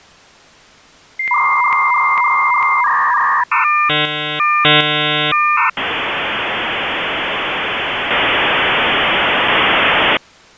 Dial-up modem handshake (V.34 or later), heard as a whistle, warbles, then hiss.